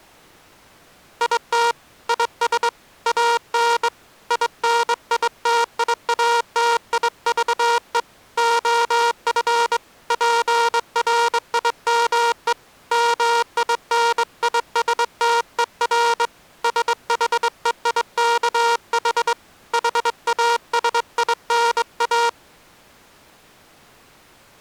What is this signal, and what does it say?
Morse code, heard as a buzzer, hand-sent with a straight key, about 22 wpm. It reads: IT IS AN INITIATIVE OF PRIME MINISTER SHEIKH HASINA